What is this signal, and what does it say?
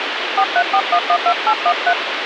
DTMF, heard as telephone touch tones, dialled by hand, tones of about 70 ms, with phone line noise. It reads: 434112813